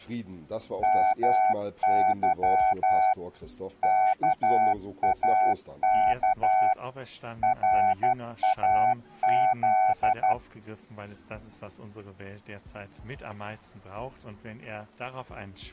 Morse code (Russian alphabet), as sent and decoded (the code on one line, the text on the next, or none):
-- -.-- / -.- .- -.- / .-. .- --..
МЫ КАК РАЗ